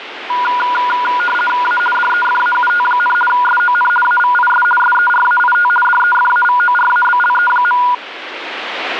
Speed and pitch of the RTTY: 50 baud, 450 Hz shift, 1210 Hz centre

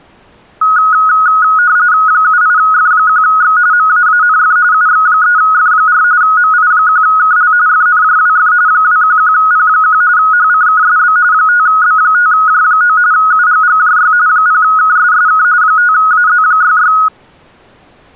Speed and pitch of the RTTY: 45.45 baud, 170 Hz shift, 1360 Hz centre

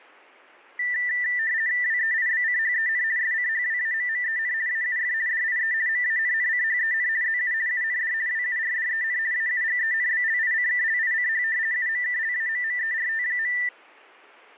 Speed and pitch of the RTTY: 50 baud, 170 Hz shift, 1900 Hz centre

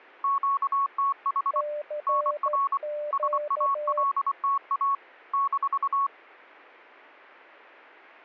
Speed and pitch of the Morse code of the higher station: 24 wpm, 1110 Hz

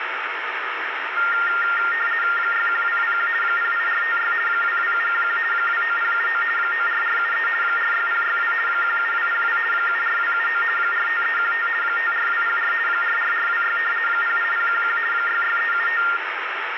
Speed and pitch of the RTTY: 50 baud, 450 Hz shift, 1600 Hz centre

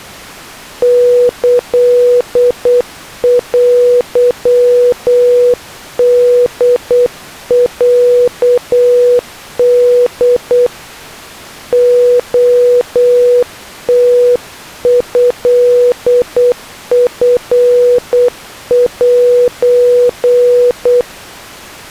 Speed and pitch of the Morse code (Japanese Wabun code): 8 wpm, 490 Hz

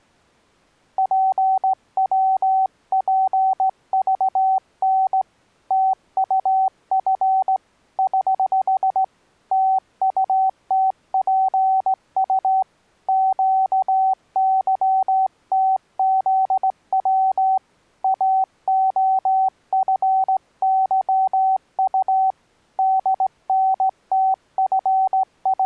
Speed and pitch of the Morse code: 17 wpm, 760 Hz

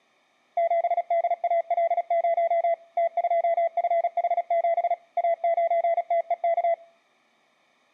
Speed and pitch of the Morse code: 36 wpm, 670 Hz

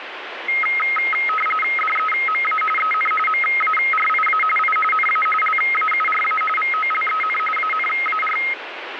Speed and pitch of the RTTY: 45.45 baud, 850 Hz shift, 1700 Hz centre

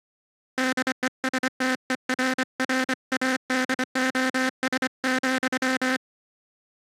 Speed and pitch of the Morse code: 25 wpm

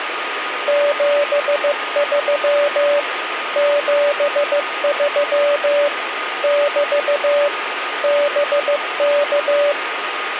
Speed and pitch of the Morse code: 15 wpm, 580 Hz

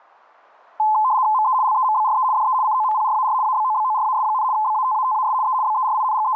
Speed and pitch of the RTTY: 75 baud, 170 Hz shift, 950 Hz centre

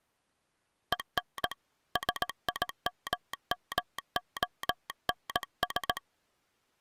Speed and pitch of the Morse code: 18 wpm

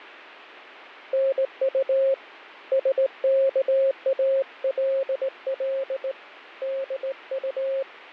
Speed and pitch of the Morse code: 19 wpm, 540 Hz

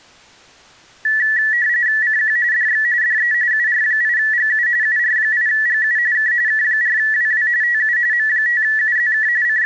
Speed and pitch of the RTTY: 45.45 baud, 170 Hz shift, 1850 Hz centre

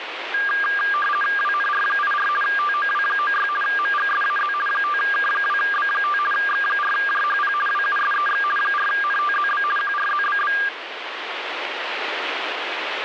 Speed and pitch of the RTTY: 50 baud, 450 Hz shift, 1400 Hz centre

